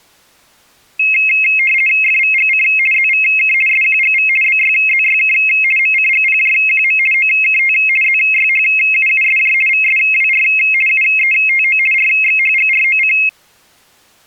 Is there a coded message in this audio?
Yes: RTTY (50 baud, 450 Hz shift) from 1.0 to 13.3 s, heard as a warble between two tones, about 2350 Hz centre. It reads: FVGC ZVK SQGV BYZYK MCGPJQM OKT ZYHUUSJ VSWR UETO RXHGROC